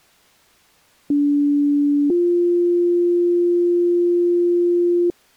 Two-tone page, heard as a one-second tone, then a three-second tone, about 290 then 350 Hz.